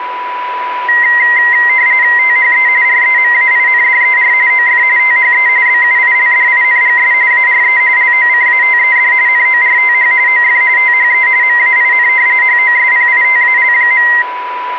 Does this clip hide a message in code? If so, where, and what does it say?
Yes: RTTY (45.45 baud, 170 Hz shift) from 0.9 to 14.2 s, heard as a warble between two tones, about 2000 Hz centre, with radio static and a steady whistle near 990 Hz. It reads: THE REMAINDER OF THE BUILDINGS ARE LOCATED NORTH OF THE MAIN HOSPITAL.